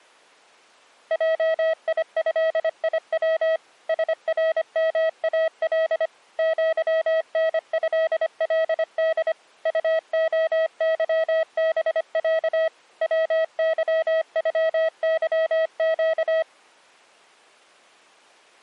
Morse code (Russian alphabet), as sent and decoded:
.--- .. ..-.. .. .-- / ... .-. -- .- .-.. / --.-- -. ..-.. .-.. -.. / ..- --- -.-- -... .-.- / .-- -.-- ..-- -.-- --.-
ЙИЭИВ СРМАЛ ЪНЭЛД УОЫБЯ ВЫЮЫЩ

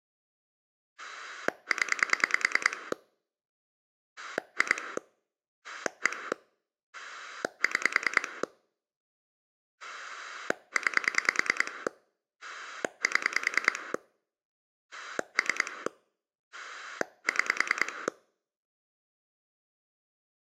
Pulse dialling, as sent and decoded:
10 / 2 / 1 / 6 / 9 / 7 / 3 / 6
0 2 1 6 9 7 3 6

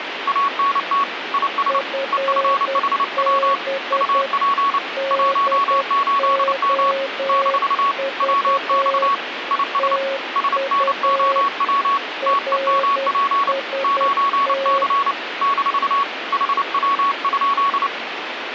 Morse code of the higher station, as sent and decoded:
.- -. - / .. ... / . ..-. .... .-- / ..- .--. / .---- ---.. -- / -....- / .-- -..- / .. ... / ... -. --- .-- / - . -- .--. / ----. -.-. / -....- / .... .-- ..--..
ANT IS EFHW UP 18M - WX IS SNOW TEMP 9C - HW?

